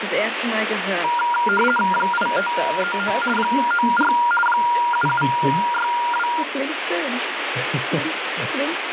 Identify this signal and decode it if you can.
RTTY (50 baud, 450 Hz shift), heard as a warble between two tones, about 1180 Hz centre, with radio static. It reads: 8539 94 7762